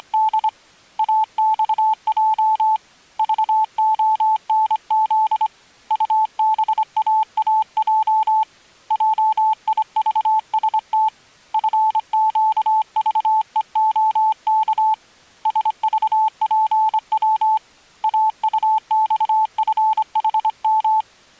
Morse code, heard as a keyed tone, hand-sent with a straight key, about 25 wpm, 870 Hz. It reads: … AXJ VONZ UBAAJ JIVST FQVEOK SVPW AUXFHM